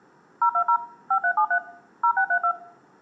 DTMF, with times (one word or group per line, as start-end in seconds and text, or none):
0.4-0.8 020
1.1-1.6 5373
2.0-2.5 0632